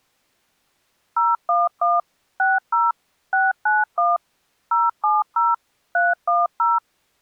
DTMF, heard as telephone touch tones, dialled by machine, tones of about 190 ms. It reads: 011 60 691 070 310